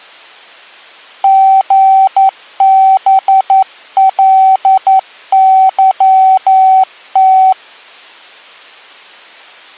Morse code, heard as a keyed tone, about 11 wpm, 760 Hz. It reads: GBLYT